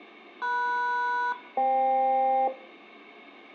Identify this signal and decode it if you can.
Aircraft SELCAL, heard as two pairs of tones. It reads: MS-FK